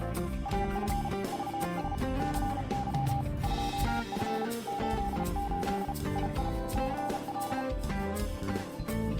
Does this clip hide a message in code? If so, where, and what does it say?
Yes: Morse code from 0.4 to 7.7 s, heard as a keyed tone, hand-sent with a paddle, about 34 wpm, 800 Hz. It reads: AF VS CY 2F 88 II CL